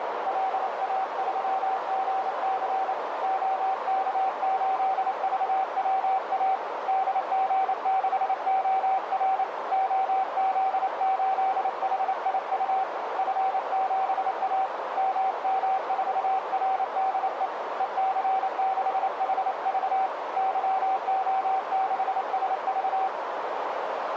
Morse code, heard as a keyed tone, hand-sent with a paddle, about 28 wpm, 770 Hz, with heavy radio static and a narrow filter. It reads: LA3GC OK8VWA DG6OR OZ8HIU F7A MM4RDE EC6HV YO6SV